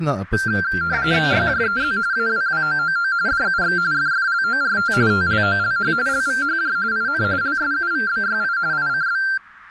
RTTY (45.45 baud, 170 Hz shift), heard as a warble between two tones, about 1480 Hz centre, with speech in Malay. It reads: YJEZ AWWOOO DUX FFLORT TLOLH LVHJ IN LSUVBYI ICB